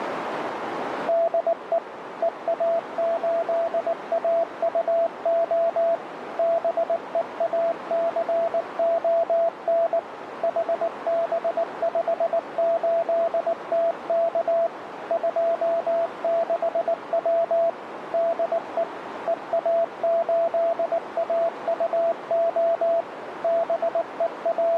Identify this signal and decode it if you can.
Morse code, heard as a keyed tone, machine-sent, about 19 wpm, 670 Hz, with radio static and a narrow filter. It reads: DE EA8AUO BEACON HB58TK 26W DE EA8AUO …